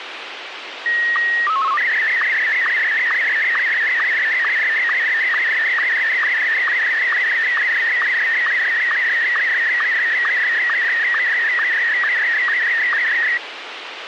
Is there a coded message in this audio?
Yes: SSTV (slow-scan television), Martin M1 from 0.9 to 13.4 s, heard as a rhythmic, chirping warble, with radio hiss.